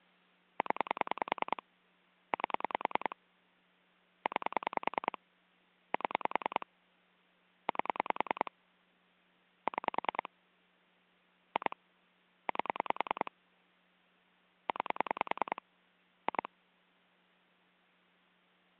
Pulse dialling, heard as clicks on a phone line, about 10 pulses a second. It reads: 0 8 9 7 8 6 2 8 9 2